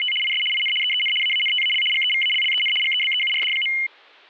RTTY (75 baud, 850 Hz shift), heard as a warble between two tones, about 2550 Hz centre, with static crashes. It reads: … IS IN EEN AANTAL GEVALLEN GEBEURD.